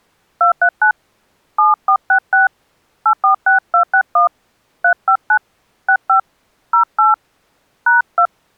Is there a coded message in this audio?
Yes: DTMF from 0.4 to 8.3 s, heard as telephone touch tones, dialled by hand, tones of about 120 ms. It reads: 239 7466 846261 359 65 08 #2